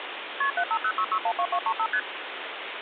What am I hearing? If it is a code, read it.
Multi-frequency trunk signalling (R1, as on North American trunks), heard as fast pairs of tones, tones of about 70 ms, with phone line noise. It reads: KP 7506612235 ST